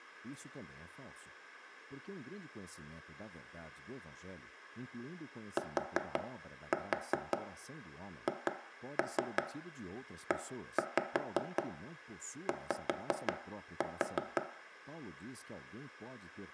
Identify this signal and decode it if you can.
Tap code, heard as knocks on wood, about 5 knocks a second, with room echo and speech in Portuguese. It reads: THEY